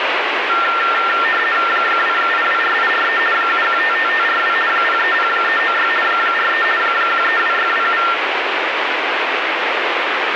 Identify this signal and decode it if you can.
RTTY (50 baud, 450 Hz shift), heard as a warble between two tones, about 1600 Hz centre, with radio static. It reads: 2824843 7155542 030396 43 132627